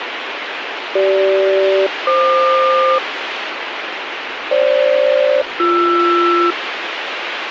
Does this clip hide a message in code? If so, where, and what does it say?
Yes: aircraft SELCAL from 1.0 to 6.5 s, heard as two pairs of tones, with radio hiss. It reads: CG-FQ FG-BR